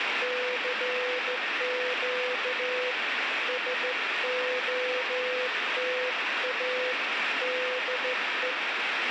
Morse code, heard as a keyed tone, hand-sent with a straight key, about 14 wpm, 500 Hz, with radio static. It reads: CQ SOTA DE